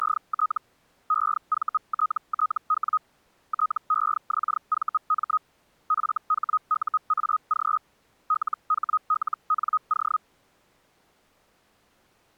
Hellschreiber (Feld-Hell, 122.5 baud), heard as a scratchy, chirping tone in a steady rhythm, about 1260 Hz. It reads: … EVTTW TEXVM FHUAG LHLNO